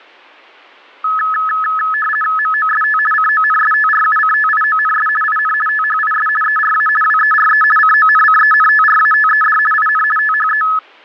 RTTY (50 baud, 450 Hz shift), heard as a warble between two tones, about 1500 Hz centre. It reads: MOST CONSTRUCTIONS IN THIS ERA WERE CONCENTRATED IN THE